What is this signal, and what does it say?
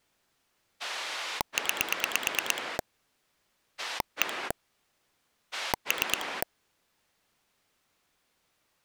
Pulse dialling, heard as a rotary dial, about 9 pulses a second. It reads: 9 1 3